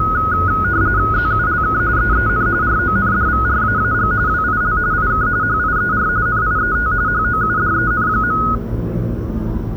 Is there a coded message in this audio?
Yes: RTTY (45.45 baud, 170 Hz shift) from 0.0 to 8.6 s, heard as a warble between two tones, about 1360 Hz centre, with the noise of a residential street. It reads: ZULK EEN RONDVRAAG WIL IK HIER NIET HOUDEN.